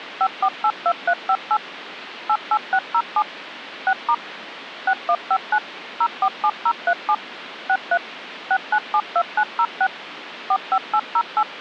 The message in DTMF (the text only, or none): 5482358 88607 6* 6159 047037 63 6972906 45808